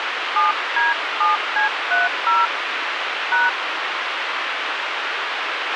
DTMF, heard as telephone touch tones, dialled by hand, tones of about 150 ms, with radio hiss and a squelch burst at the end. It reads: 7D7C30 #